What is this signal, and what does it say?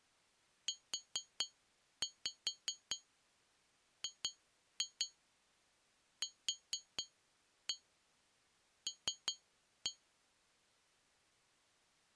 Tap code, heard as taps on glass, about 4 knocks a second. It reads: UGQL